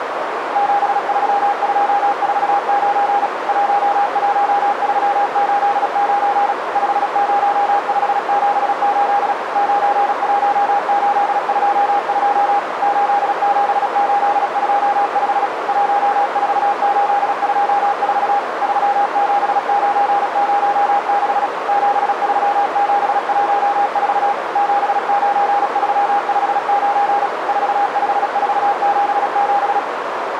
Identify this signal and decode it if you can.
Morse code, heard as a keyed tone, machine-sent, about 36 wpm, 810 Hz, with radio static and a narrow filter. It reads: 73249 11389 50578 91822 87825 14824 37906 73714 79359 45477